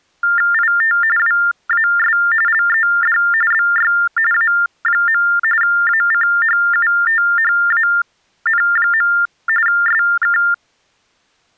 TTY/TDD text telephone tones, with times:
0.5-1.0 IT
1.2-2.2 WAS
2.5-3.2 LED
3.5-3.9 BY
4.3-5.2 A.
5.6-9.1 ACHUTHAN.
9.7-10.4 SK

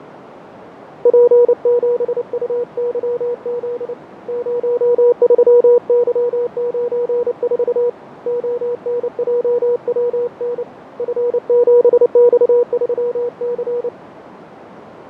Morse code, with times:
1.1-3.9 P7UYZ
4.3-7.9 03Y94
8.3-10.6 ONJWN
11.0-13.9 F7X3C

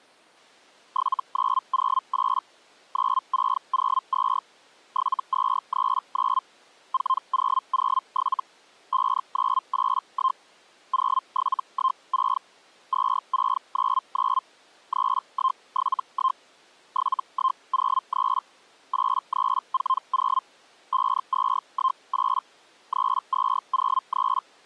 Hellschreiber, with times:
0.9-2.4 7908
2.9-4.4 9602
4.9-6.4 7239
6.9-8.4 4007
8.9-10.4 5981
10.9-12.4 0716
12.9-14.4 2699
14.9-16.4 3171
16.9-18.4 7103
18.9-20.4 8340
20.9-22.4 5218
22.9-24.4 3203

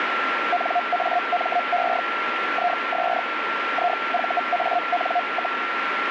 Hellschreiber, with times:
0.5-2.0 NAME
2.5-3.2 IS
3.7-5.6 IVAN,

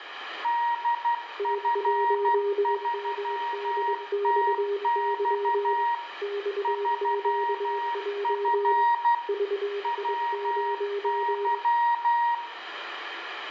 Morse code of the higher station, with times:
0.4-5.9 DF3TX
6.6-9.1 3F
9.8-12.3 WY

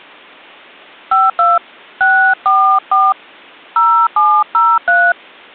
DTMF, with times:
1.1-1.6 52
2.0-3.1 644
3.8-5.1 0703

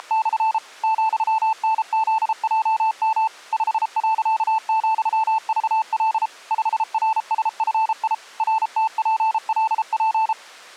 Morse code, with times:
0.0-0.6 …
0.8-3.3 ,NZJM
3.5-6.3 5.,VL
6.5-8.1 5RSFI
8.4-10.3 RTPLP

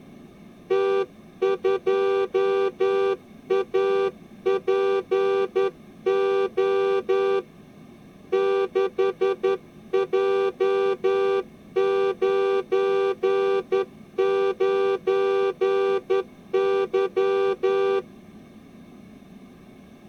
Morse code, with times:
0.7-7.4 T2APO
8.3-18.0 6J99Y

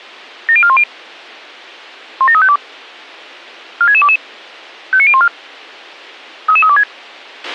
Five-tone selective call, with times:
0.5-0.8 70410
2.2-2.6 17352
3.8-4.2 46622
4.9-5.3 59014
6.5-6.8 33326

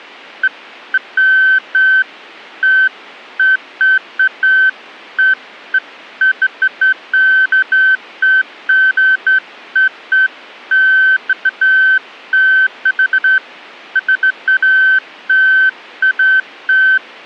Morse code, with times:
none

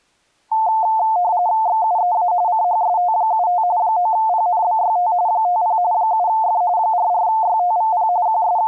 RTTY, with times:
1.7-2.3 XUEA
2.5-3.6 CHST75
3.8-5.1 9PNBYT
5.3-5.8 50
5.9-6.6 7F
6.8-8.1 44YTVP
8.3-8.7 …

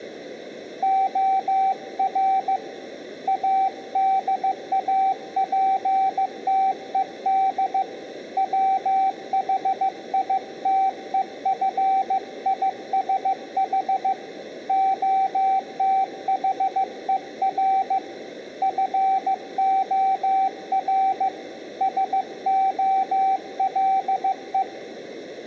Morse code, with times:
0.8-2.6 OR
3.3-7.8 ADAPTED
8.4-14.1 WHITEFISH
14.7-18.0 OTHER
18.6-21.3 FOR
21.8-24.6 SOLE

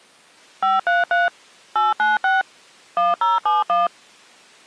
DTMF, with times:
0.6-1.3 533
1.8-2.4 896
3.0-3.9 1071

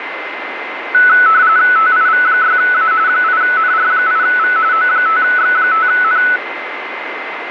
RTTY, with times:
1.8-2.9 TIV6A
3.1-4.6 8NR8V
4.7-6.2 O5X5N

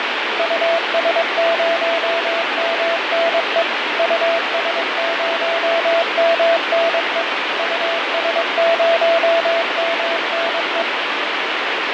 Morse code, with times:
0.4-3.6 US0MNE
4.0-7.2 US0MNE
7.6-10.8 US0MNE

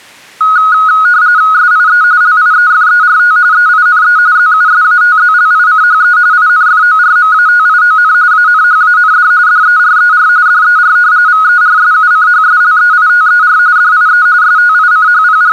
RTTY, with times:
1.5-2.0 SIE
2.2-3.4 LIEFERT
3.5-4.2 EINE
4.4-6.2 ZUSATZLICHE
6.3-8.1 INFORMATION
8.3-9.3 ANHAND
9.5-10.3 DERER
10.5-11.0 DER
11.3-13.6 VERSUCHSLEITER
13.8-14.3 DIE
14.4-15.5 …

